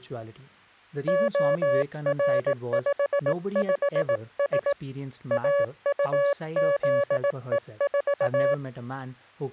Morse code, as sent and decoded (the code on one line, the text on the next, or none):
--- .-. ..... ..... ... / .- ..- --.. . ....-
OR55S AUZE4